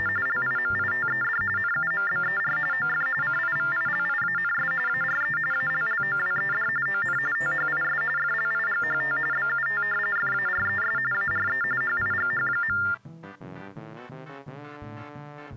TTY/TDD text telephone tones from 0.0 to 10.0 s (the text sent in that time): … LIMITED NUMBER OF CIVILIANS ARE ALLOWED ON THIS FLIGHT BUT